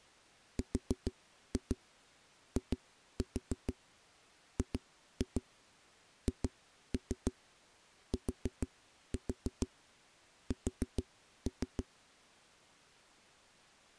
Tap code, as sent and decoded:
4-2 2-4 2-2 2-3 4-4 4-3
RIGHTS

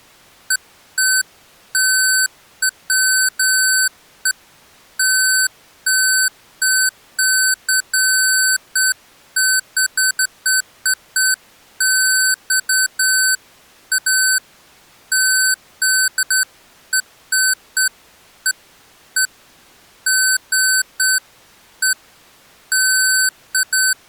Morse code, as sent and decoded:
none

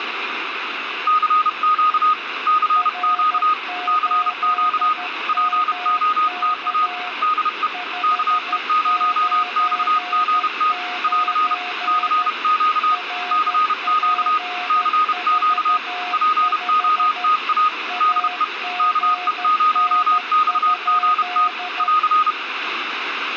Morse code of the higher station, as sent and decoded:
-.-. --.- / -.-. --.- / -.-. --.- / .--. --- - .- / -.. . / -.- . ----- -..- --. - / .-.-. / -.-. --.- / -.-. --.- / -.-. --.- / .--. --- - .- / -.. . / -.- . ----- -..- --. - / .-.-.
CQ CQ CQ POTA DE KE0XGT <AR> CQ CQ CQ POTA DE KE0XGT <AR>

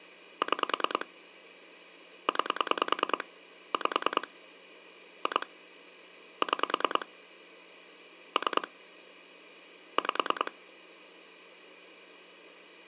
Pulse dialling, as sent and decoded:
6 / 9 / 5 / 2 / 6 / 3 / 5
6 9 5 2 6 3 5

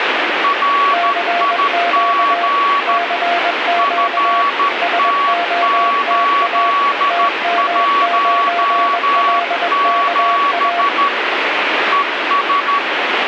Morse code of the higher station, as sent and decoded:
.-. .. --. / ..-. - ---.. .---- --... / . ...
RIG FT817 ES

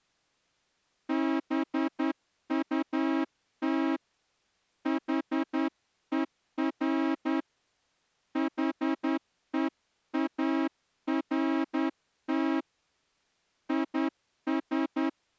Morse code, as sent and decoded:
-... ..- - / .... . .-. / .... . .- .-. - / .. ...
BUT HER HEART IS

